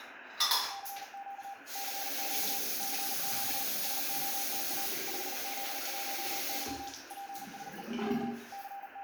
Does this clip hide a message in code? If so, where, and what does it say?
Yes: Morse code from 0.6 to 9.0 s, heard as a keyed tone, machine-sent, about 39 wpm, 790 Hz, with radio static, room echo and the noise of a restroom. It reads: CQ CQ CQ SOTA 5Z1Y PSE K …